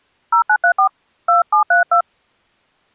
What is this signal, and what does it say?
DTMF, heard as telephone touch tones, dialled by hand, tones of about 100 ms. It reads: 0934 2732